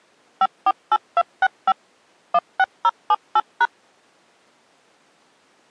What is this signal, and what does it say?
DTMF, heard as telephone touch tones, dialled by machine, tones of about 50 ms. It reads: 548265 16078#